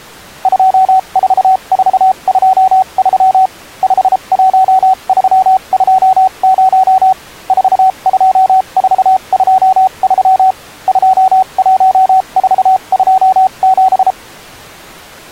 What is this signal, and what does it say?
Morse code, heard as a keyed tone, machine-sent, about 33 wpm, spaced as for 28 wpm, 760 Hz. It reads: 24423 51320 42423 21427